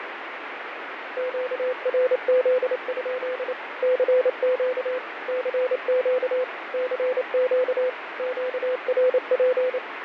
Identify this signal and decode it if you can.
Morse code, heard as a keyed tone, machine-sent, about 28 wpm, 510 Hz, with radio static and fading. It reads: QRZ? CQ CQ CQ QRP